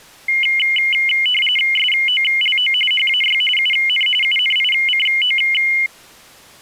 RTTY (45.45 baud, 850 Hz shift), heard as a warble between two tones, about 2550 Hz centre. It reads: SOLO HAY UN UNICO